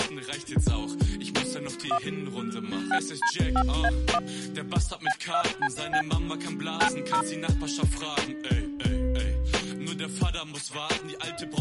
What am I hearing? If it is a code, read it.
DTMF, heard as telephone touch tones, dialled by hand, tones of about 70 ms. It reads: 1 6D5A1 B2CB 90